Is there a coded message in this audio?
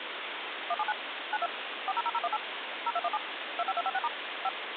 Yes: DTMF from 0.7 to 4.5 s, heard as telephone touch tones, dialled by machine, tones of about 40 ms, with phone line noise. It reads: 179 92 400018 0217 25256* 5